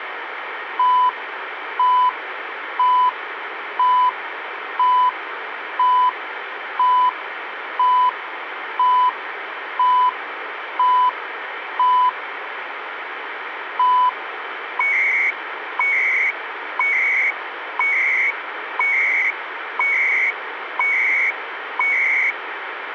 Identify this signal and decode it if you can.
Radio time signal (CHU, Canada), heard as beeps and data bursts, one a second, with radio static.